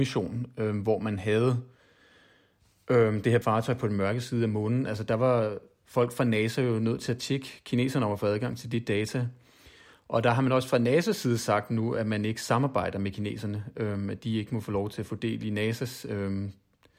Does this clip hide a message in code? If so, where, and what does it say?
No, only speech in Danish.